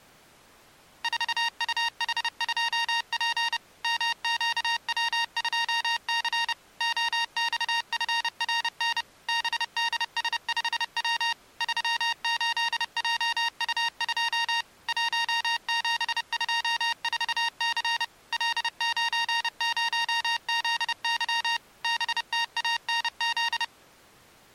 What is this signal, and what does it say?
Morse code, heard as electronic beeps, machine-sent, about 30 wpm, 930 Hz. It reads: 4UH2P MQW2C OXFRN BDS5W 38JU2 1724C L90ZY BTANZ